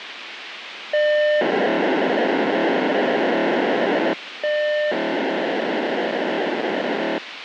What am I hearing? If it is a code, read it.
POCSAG pager data (1200 baud), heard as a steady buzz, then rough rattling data, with radio hiss.